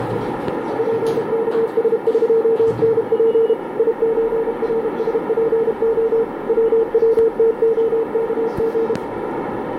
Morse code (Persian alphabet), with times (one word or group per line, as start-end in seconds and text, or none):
0.8-3.5 پکسقنپ
3.8-6.2 یچرسپع
6.5-8.9 ووتعکژ